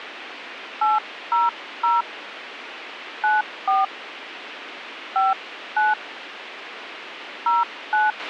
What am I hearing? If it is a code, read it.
DTMF, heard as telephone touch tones, dialled by hand, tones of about 180 ms, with radio hiss and a squelch burst at the end. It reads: 800 94 59 09